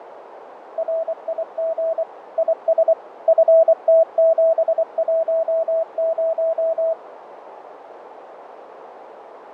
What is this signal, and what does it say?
Morse code, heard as a keyed tone, machine-sent, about 24 wpm, 650 Hz, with radio static, fading and a narrow filter. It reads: RIG IS FT710